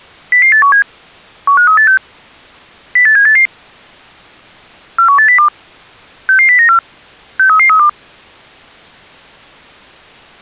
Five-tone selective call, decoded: 00817 15386 08788 41802 66094 63332

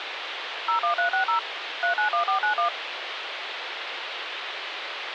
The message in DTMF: 01360 391491

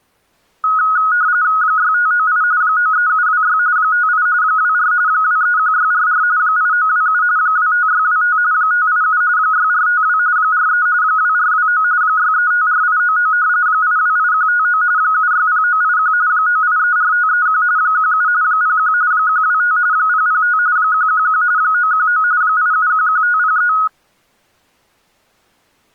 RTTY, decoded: 6598 93726 58 24 231644 8927 25625 587 6452 43 2429 6354899 828159 760981 9834531 17 01 125 005 111 919 8711503

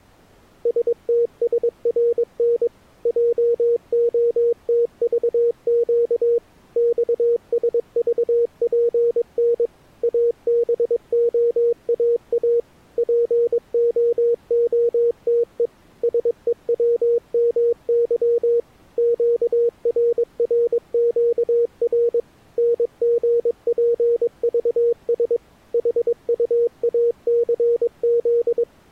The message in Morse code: STSRN JOTVQ XSVPN ABOAA POOTE SEWMY QRRQR NGPVS HUACZ

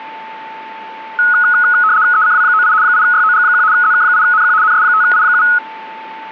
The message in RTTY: ECW98 8YOG1 ZK8NQ NS5I7

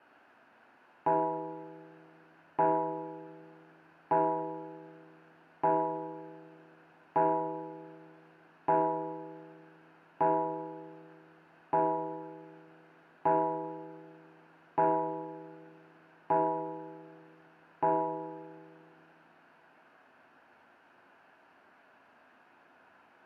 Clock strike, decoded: 12

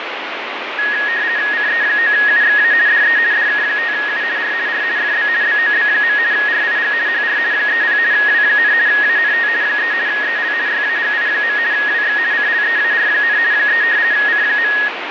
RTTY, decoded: CE9UXA DE DK5U R R FB BOB. RIG HR 30 W, ANT 3 EL YAGI. WX CLEAR, 3 C.

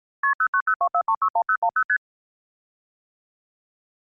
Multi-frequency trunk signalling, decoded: KP 09024361010 ST

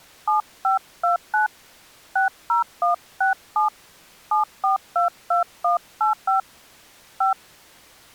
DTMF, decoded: 7529 60167 7422185 5

